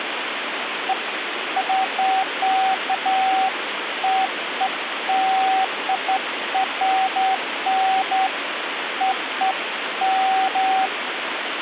Beeps of irregular length, with phone line noise. There is no code.